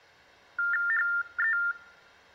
TTY/TDD text telephone tones (45.45 baud Baudot), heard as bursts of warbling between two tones, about 400 Hz shift, 1600 Hz centre. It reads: HE